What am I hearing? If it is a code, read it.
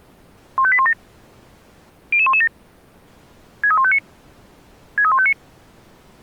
Five-tone selective call (ZVEI), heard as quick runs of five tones, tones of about 70 ms. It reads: 15817 00117 63159 63159